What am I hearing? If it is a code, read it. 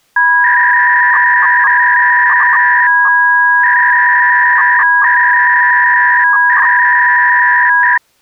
300-baud modem data (V.21 tones), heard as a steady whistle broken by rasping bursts, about 300 baud, 200 Hz shift.